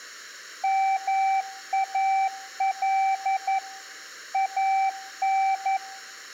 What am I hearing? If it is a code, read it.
Morse code (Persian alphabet), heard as a keyed tone, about 11 wpm, 770 Hz, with room echo. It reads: مال ان